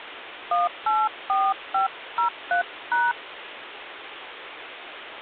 DTMF, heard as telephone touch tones, dialled by hand, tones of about 190 ms, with phone line noise. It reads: 184503#